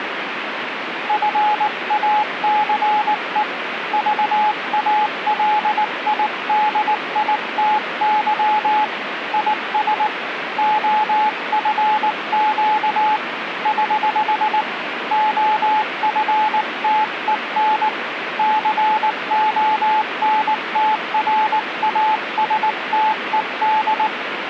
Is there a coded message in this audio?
Yes: Morse code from 1.0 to 24.1 s, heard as a keyed tone, hand-sent with a paddle, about 19 wpm, 860 Hz, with radio static. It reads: FACE VALIDITY IS OFQ <HH> OFTEN CONTRASTED